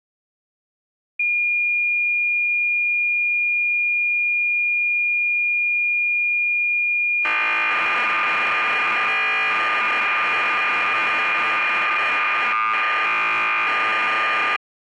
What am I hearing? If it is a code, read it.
Cassette data (Kansas City type), 1200 baud, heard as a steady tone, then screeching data.